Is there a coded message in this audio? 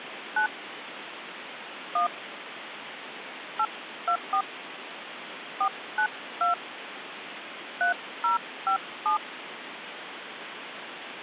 Yes: DTMF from 0.4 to 9.2 s, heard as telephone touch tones, dialled by hand, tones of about 90 ms, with phone line noise. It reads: 9 1 824 492 3057